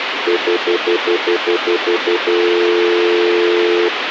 Telephone call progress tone (North American plan), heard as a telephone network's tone, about 350, 440 Hz, 0.1 s on and 0.1 s off, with phone line noise. Stutter dial tone.